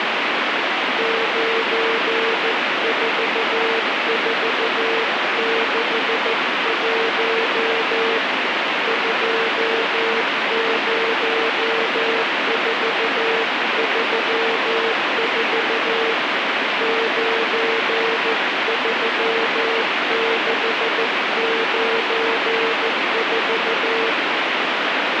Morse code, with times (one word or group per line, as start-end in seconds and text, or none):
1.0-8.2 94461
8.9-16.1 20434
16.8-24.1 93694